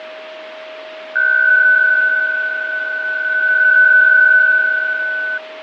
PSK63 (62.5 baud), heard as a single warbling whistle, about 1500 Hz, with radio static, fading and a steady whistle near 630 Hz.